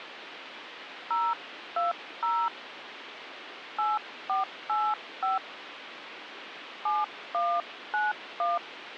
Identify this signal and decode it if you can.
DTMF, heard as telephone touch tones, dialled by hand, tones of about 200 ms, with phone line noise. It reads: 020 8485 7191